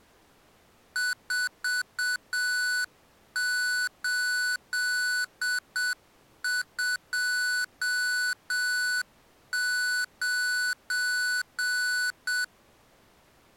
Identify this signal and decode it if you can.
Morse code, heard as electronic beeps, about 7 wpm, 1490 Hz. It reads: 4829